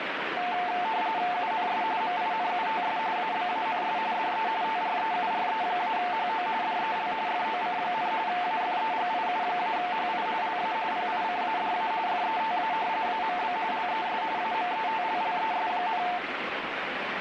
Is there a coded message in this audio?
Yes: RTTY (45.45 baud, 170 Hz shift) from 0.4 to 16.2 s, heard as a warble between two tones, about 800 Hz centre, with radio static. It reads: UNS MINUTS ABANS DE TREURE-HO DEL FOC, AFEGIU-HI LA PICADA FETA AMB LES AMETLLES,